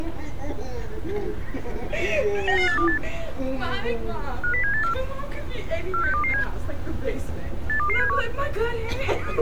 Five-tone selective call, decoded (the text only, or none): 99828 50784 46227 82271